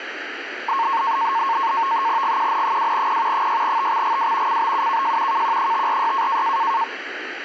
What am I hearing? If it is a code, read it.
NAVTEX (SITOR-B), 100 baud, 170 Hz shift, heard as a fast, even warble, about 1000 Hz centre. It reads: GQN2P 6TXGW CBUKJ KQ546